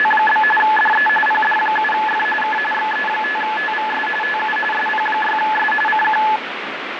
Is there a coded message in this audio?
Yes: RTTY (45.45 baud, 850 Hz shift) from 0.0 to 6.4 s, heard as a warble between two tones, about 1290 Hz centre, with radio static. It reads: … DE PD7F K XE5TVS TU SP6S CQ